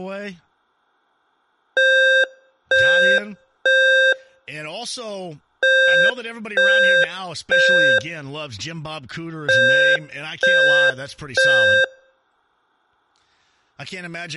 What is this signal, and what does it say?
Alarm pattern, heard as an alarm's beeps, played three times, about 530 Hz, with speech in English. Temporal three. Smoke or fire, evacuate.